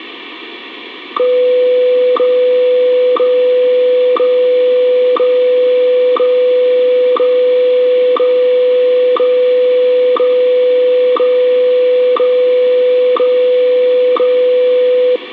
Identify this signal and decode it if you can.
Radio time signal (WWVH, Hawaii), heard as ticks, one a second, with radio static and room echo.